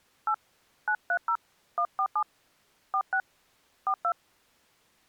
DTMF, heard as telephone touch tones, dialled by hand, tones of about 70 ms. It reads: 8 930 147 46 42